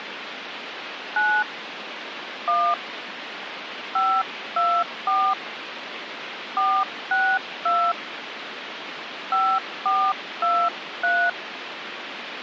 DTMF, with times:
1.2-1.4 9
2.5-2.7 1
4.0-5.3 524
6.6-7.9 462
9.3-11.3 5423

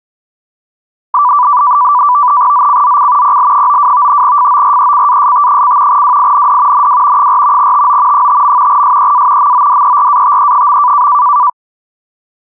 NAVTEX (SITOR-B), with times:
2.5-3.4 ZCZC
3.2-4.2 PL92
4.2-6.0 FORECAST:
5.9-6.9 WIND
6.7-7.3 NW
7.2-7.7 4
7.6-8.3 TO
8.1-8.8 5.
8.7-9.5 SEA
9.4-11.1 MODERATE.

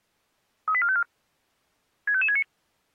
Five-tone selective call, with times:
0.7-1.0 38454
2.1-2.4 65569

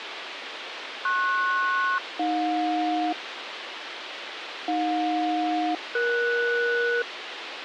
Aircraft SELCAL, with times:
1.0-3.1 PS-AJ
4.7-7.0 AJ-ES

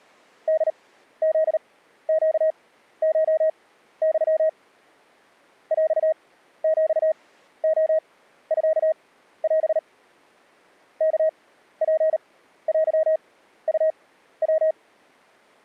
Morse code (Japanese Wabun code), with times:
0.5-4.5 ホフネコユ
5.7-9.8 ヰヒレミオ
11.0-14.7 ワツテウヤ

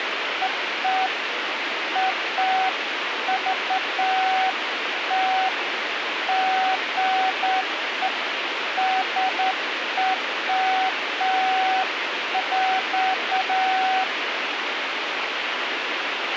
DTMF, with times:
none

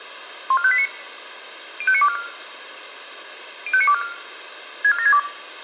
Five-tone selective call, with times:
0.5-0.9 14589
1.8-2.2 05924
3.7-4.0 05924
4.8-5.2 64762

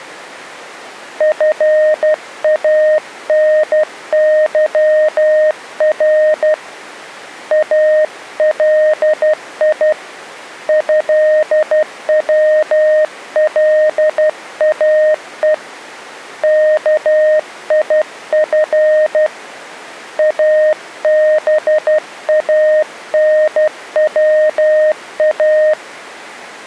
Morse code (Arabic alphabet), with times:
1.2-6.5 فانظر
7.5-9.9 الي
10.7-15.5 هولاء
16.4-19.3 كيف
20.2-25.7 ابانوا

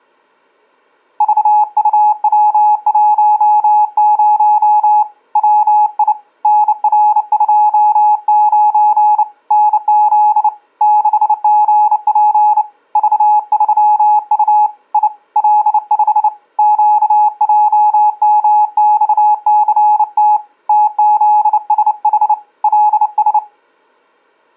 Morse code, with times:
1.2-5.0 VUW10
5.4-6.1 WI
6.4-9.2 NR29
9.5-10.5 NZ
10.8-12.6 6GP
13.0-14.7 V3U
14.9-15.1 I
15.4-16.3 L5
16.6-20.4 QJMXCT
20.7-22.3 TZSH
22.6-23.4 LS

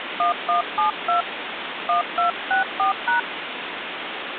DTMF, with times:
0.2-1.2 1172
1.9-3.2 1264#

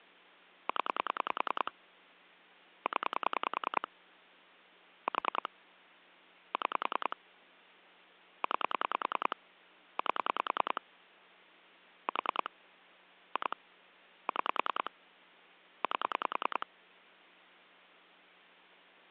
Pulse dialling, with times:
0.7-1.7 0
2.9-3.9 0
5.1-5.5 4
6.5-7.2 6
8.4-9.4 9
10.0-10.8 8
12.1-12.5 4
13.4-13.6 2
14.3-14.9 6
15.8-16.7 8

